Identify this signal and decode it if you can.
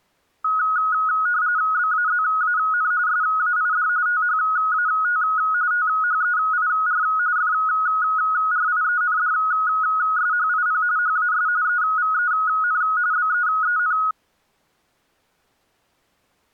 RTTY (45.45 baud, 170 Hz shift), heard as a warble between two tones, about 1360 Hz centre. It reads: BAZAN SAID THAT THEIR FRIENDSHIP HAS EVEN BEEN